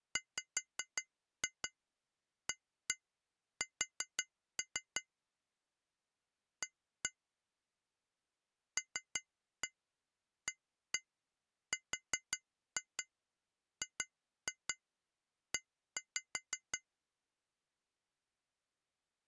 Tap code, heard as taps on glass, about 5 knocks a second. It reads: WAS A LARGE